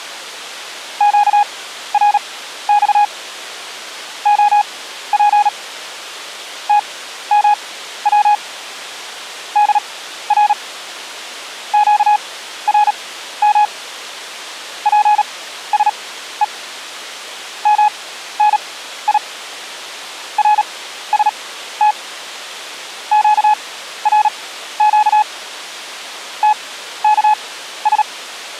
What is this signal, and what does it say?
Morse code, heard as a keyed tone, machine-sent, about 37 wpm, spaced as for 14 wpm, 840 Hz. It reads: QRX OP TMW DR QRM PSE MNI RST QRQ TKS